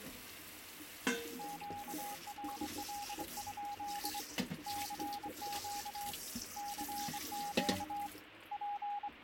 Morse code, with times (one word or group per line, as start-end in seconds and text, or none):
1.4-4.2 QRL?
4.7-6.1 CQ
6.6-8.1 CQ
8.5-9.2 …